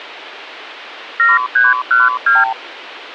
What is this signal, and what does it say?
Multi-frequency trunk signalling (R2, with the far end's replies), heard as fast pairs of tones, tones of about 180 ms. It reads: 7312